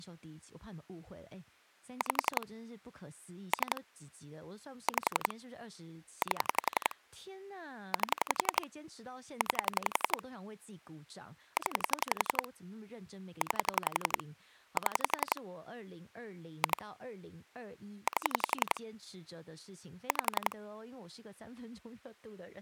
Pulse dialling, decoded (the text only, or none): 5 3 5 8 8 9 0 9 7 2 8 5